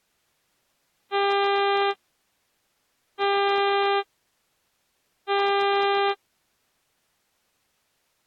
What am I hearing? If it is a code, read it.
Ship horn signal, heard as a ship's horn, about 400 Hz. 3 short. At sea: I am operating astern propulsion.